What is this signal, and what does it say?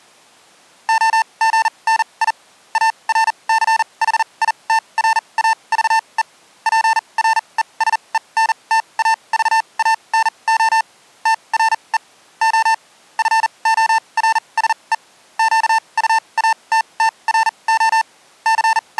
Morse code, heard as electronic beeps, machine-sent, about 40 wpm, spaced as for 28 wpm, 890 Hz. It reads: OGNI ARCHITRAVE PRESENTAVANO TRE O FORSE QUATTRO …